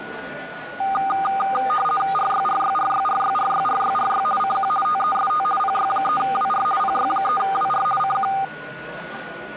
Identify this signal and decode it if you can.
RTTY (50 baud, 450 Hz shift), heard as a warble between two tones, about 1000 Hz centre, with a steady whistle near 1460 Hz and the noise of a restaurant. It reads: RYRYRYRYRYRYRY CQ TEST PY3WR PY3WR CQ